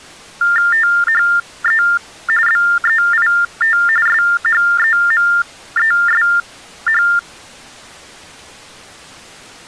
TTY/TDD text telephone tones (45.45 baud Baudot), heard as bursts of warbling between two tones, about 400 Hz shift, 1600 Hz centre. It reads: THE BEIT SHEMESH